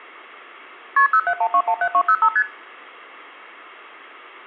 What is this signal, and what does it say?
Multi-frequency trunk signalling (R1, as on North American trunks), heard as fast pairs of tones, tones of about 70 ms. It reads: KP 071217205 ST